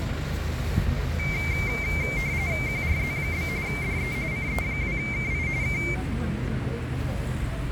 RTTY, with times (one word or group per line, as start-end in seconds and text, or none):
2.7-3.5 QRZ?
3.7-4.1 DE
4.3-5.5 CE2KI
5.6-5.8 K